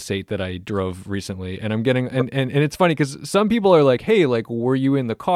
Speech in English. There is no code.